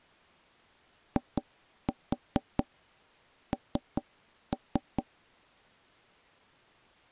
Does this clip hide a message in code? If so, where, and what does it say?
Yes: tap code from 1.2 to 5.1 s, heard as knocks on wood, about 4 knocks a second. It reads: IN